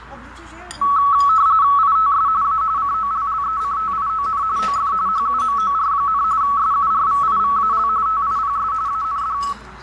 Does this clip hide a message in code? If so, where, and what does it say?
Yes: RTTY (45.45 baud, 170 Hz shift) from 0.8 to 9.5 s, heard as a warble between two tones, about 1210 Hz centre, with radio static, fading, a narrow filter and the noise of a restaurant. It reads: ITS A COLLECTION OF HUMOR, SURVIVAL TIPS AND